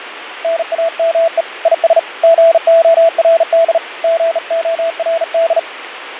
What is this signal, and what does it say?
Morse code, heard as a keyed tone, hand-sent with a bug key, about 38 wpm, 660 Hz, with radio static and fading. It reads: NAME IS GORD GORD